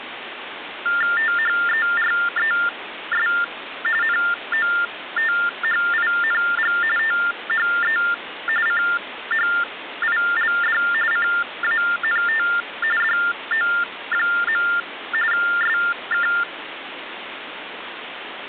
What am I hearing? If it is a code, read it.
TTY/TDD text telephone tones (45.45 baud Baudot), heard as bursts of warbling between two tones, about 400 Hz shift, 1600 Hz centre, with phone line noise. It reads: THERES NOTHING THE CHILD CANT DO. SK